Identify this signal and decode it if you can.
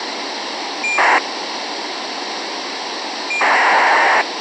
ACARS aircraft data, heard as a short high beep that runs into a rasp, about 2400 baud, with radio hiss.